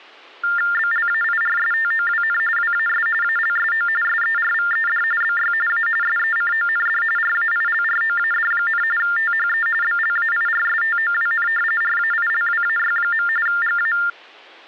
TTY/TDD text telephone tones (45.45 baud Baudot), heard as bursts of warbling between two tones, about 400 Hz shift, 1600 Hz centre. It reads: BLAIRSTOWN WAS ALSO SERVED BY A SECOND RAILROAD, THE BLAIRSTOWN RAILWAY. GA